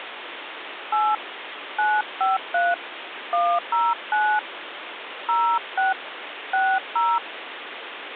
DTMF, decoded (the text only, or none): 8 953 109 06 60